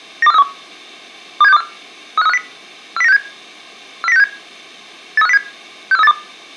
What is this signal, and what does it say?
Five-tone selective call (EEA), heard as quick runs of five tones, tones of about 40 ms. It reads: 92431 27624 35350 40967 40967 83507 64382